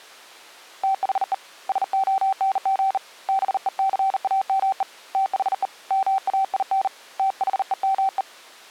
Morse code, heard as a keyed tone, hand-sent with a bug key, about 39 wpm, 770 Hz. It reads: THE SONG BECAME THE MAIN THEME